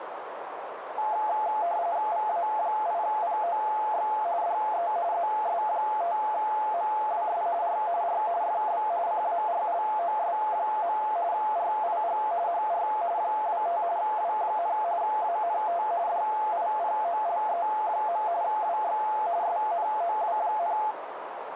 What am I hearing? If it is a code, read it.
RTTY (45.45 baud, 170 Hz shift), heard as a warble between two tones, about 770 Hz centre, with radio static and a narrow filter. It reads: VA8POX DE ZS5MWS R R FB CARLOS. RIG HR 25 W, ANT DIPOLE. WX SNOW,